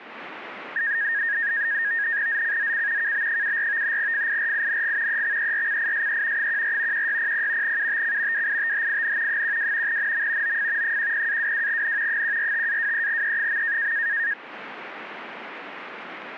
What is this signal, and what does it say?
NAVTEX (SITOR-B), 100 baud, 170 Hz shift, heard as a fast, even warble, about 1750 Hz centre. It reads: ZCZC KB74 FIRING EXERCISE 14 1600 UTC WITHIN 12 NM OF 10-22N 145-23E.